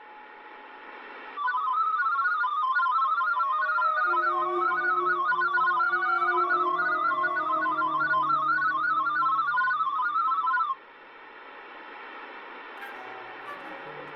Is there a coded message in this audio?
Yes: multi-tone FSK (Olivia or MFSK type), about 500 Hz wide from 1.4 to 10.8 s, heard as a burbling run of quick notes, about 31.25 baud.